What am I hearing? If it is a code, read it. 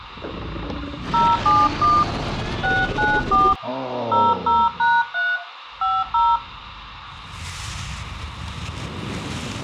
DTMF, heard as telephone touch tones, dialled by hand, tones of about 220 ms, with radio hiss. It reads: 071 694 00#3 50